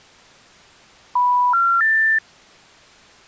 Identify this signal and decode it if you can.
Telephone call progress tone (North American plan), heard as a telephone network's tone, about 980, 1370, 1800 Hz. Special information tone.